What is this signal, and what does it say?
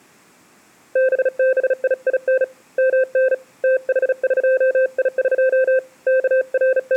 Morse code (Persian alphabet), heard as a keyed tone, hand-sent with a bug key, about 36 wpm, 520 Hz. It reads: ببیین من تحقیق …